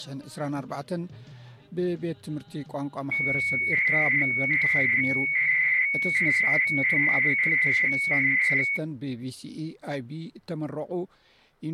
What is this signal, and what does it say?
300-baud modem data (Bell 103 tones), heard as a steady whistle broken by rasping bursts, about 300 baud, 200 Hz shift.